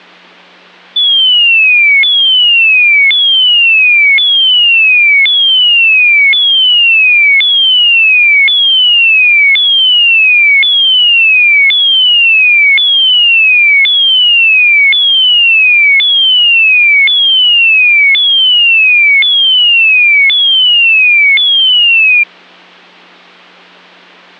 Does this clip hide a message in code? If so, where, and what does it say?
No, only a tone that sweeps in pitch again and again.